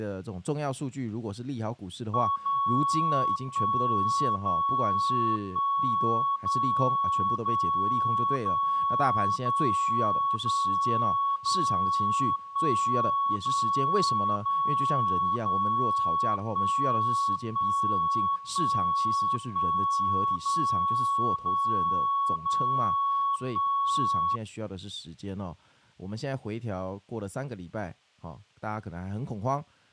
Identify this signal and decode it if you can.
Radio time signal (DCF77), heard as a tone whose level steps once a second, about 1110 Hz, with speech in Chinese. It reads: 0 1 0 1 0 0 0 0 0 0 1 0 0 0 1 1 1 1 0 0 0 1